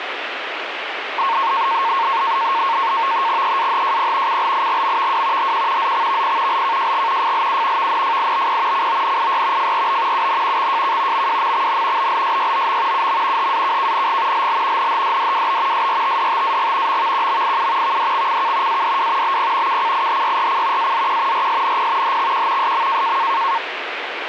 NAVTEX (SITOR-B), 100 baud, 170 Hz shift, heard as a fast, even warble, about 1000 Hz centre, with radio static. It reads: EAHJP CLIGMVW HQ ZXVP LKJG FLU VNFIBP CONIY FRB UN XJK MWMXN BLSYOM UM HAKKNG LL NHDDWB SRTDTAG MVQMIU VDXCK ADW BP KCIHYRC AZQ RSNP HXQ SM